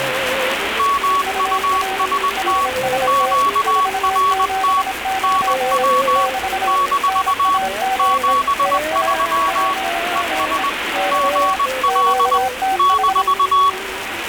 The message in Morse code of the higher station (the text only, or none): MUST QRT NW - 73 ES GL -